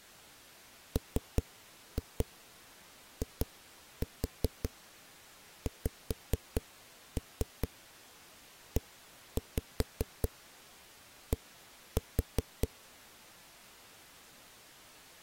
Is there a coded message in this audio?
Yes: tap code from 1.0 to 12.7 s, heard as knocks on a wall, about 5 knocks a second. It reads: MIXED